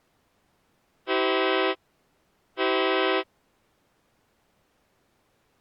Train horn signal, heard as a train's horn. 2 short. On North American railways: a signal is acknowledged.